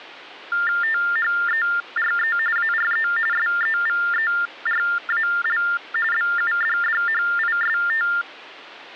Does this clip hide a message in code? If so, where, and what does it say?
Yes: TTY/TDD text telephone tones (45.45 baud Baudot) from 0.5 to 8.2 s, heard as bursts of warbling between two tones, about 400 Hz shift, 1600 Hz centre, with hum. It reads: THERE ARE SEVERAL BUDDHIST